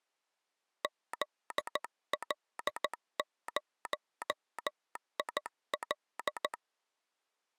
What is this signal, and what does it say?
Morse code, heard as a telegraph sounder, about 14 wpm. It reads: ZL0IL